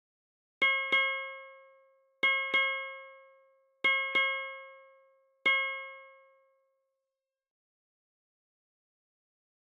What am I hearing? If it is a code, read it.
Ship's bell, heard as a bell. 7. Seven half-hours of the watch have passed.